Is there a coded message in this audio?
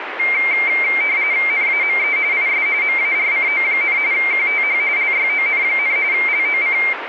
Yes: RTTY (45.45 baud, 170 Hz shift) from 0.2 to 6.9 s, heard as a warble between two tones, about 2200 Hz centre, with radio static. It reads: NAME IS MARCO, QTH LYON, LOC